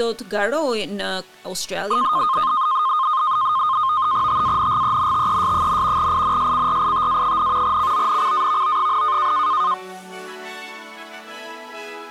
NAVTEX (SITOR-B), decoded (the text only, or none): TANGENTES, INSCRITA, CONCAVO,